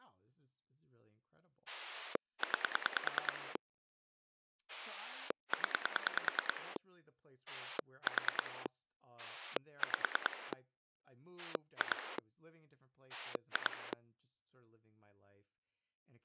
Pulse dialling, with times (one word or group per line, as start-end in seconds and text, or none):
1.7-3.6 9
4.7-6.8 0
7.5-8.7 4
9.2-10.5 5
11.4-12.2 2
13.1-13.9 2